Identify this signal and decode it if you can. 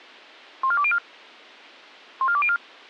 Five-tone selective call (ZVEI), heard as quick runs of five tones, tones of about 70 ms. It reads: 14204 14204